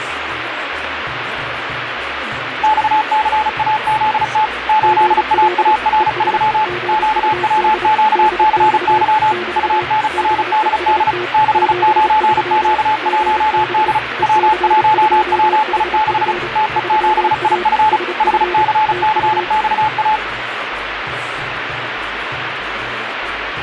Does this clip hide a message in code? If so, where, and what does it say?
Yes: Morse code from 2.6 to 20.2 s, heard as two keyed tones, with radio static. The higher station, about 35 wpm, 860 Hz: XCAZT 8AAR3 QWQCY UNRDD 69Q1D W1WI6 TE7IF HCCXA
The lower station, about 29 wpm, 360 Hz: GL ES GUD DX <BT> BEST 73 GB EC2HF 3A SF TU